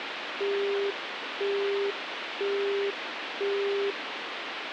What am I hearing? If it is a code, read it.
Telephone call progress tone (single-tone plan, as in Europe, Japan and elsewhere), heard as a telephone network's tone, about 400 Hz, 0.5 s on and 0.5 s off, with phone line noise. Busy tone.